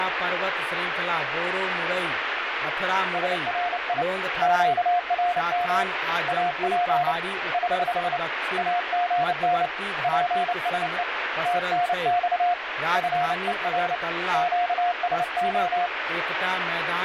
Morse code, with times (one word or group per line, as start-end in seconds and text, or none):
3.1-4.0 SRI
4.4-5.8 QRM
6.3-7.1 AP
7.5-8.2 <HH>
8.6-9.7 AGN
10.0-11.0 PSE
11.5-12.5 TNX
13.0-14.0 FER
14.3-15.9 QSO